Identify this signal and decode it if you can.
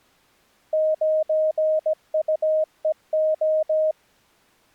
Morse code, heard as a keyed tone, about 17 wpm, 620 Hz. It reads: 9UEO